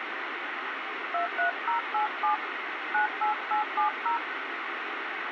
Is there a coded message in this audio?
Yes: DTMF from 1.1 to 4.2 s, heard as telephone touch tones, dialled by hand, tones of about 120 ms, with radio hiss. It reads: 23087 98870